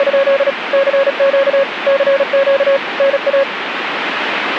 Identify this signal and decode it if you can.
Morse code, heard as a keyed tone, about 36 wpm, 550 Hz, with radio static. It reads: … CQ CQ NA